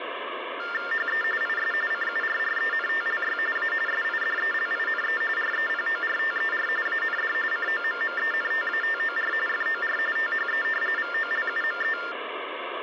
TTY/TDD text telephone tones (45.45 baud Baudot), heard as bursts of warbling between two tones, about 400 Hz shift, 1600 Hz centre, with phone line noise. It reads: HE IS CURRENTLY A SIDELINE REPORTER AND COMMENTATOR FOR THE VOLUME